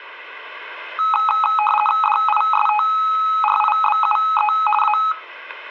RTTY (50 baud, 450 Hz shift), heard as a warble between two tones, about 1070 Hz centre. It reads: DISTRIBUE A